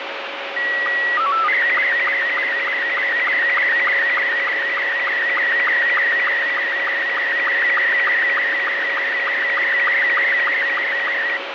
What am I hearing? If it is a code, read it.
SSTV (slow-scan television), Robot 72, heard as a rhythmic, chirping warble, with radio static.